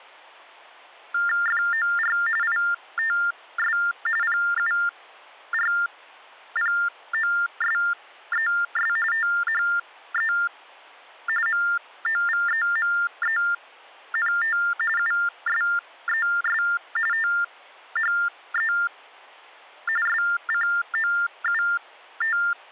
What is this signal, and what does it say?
TTY/TDD text telephone tones (45.45 baud Baudot), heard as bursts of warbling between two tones, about 400 Hz shift, 1600 Hz centre, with hum. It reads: FOR ITS PURPOSES THE MOVEMENT USES THE SCOUT